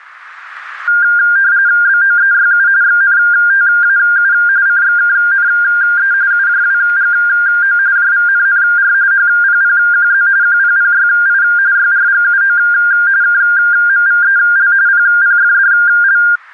RTTY (45.45 baud, 170 Hz shift), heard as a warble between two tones, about 1500 Hz centre, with radio static. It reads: BOEYU XNTAU CXKNE UJWGO JVNNR HPPQZ QPPYI YRGUO KMVEL PPFDL